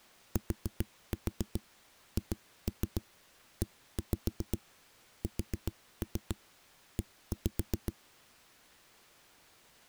Tap code, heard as knocks on a wall, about 7 knocks a second. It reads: THESE